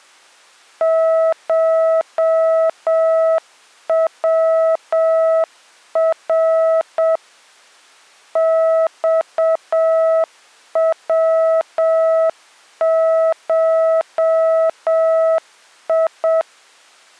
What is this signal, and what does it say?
Morse code (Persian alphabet), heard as a keyed tone, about 7 wpm, 650 Hz. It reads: شور خوشی